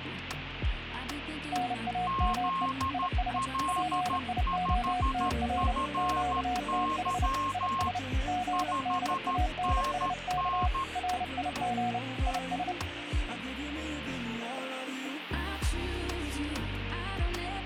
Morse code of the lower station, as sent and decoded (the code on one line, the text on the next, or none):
-. .- -- . / .. ... / .--. .. --- - .-. / --.- - .... / .. ... / --. -.. .- -. ... -.- / .-. .. --. / .. ...
NAME IS PIOTR QTH IS GDANSK RIG IS